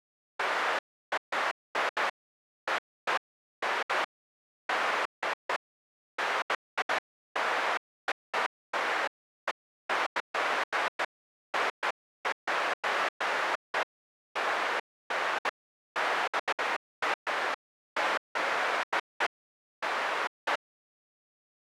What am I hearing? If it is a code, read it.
Bursts of noise. There is no code.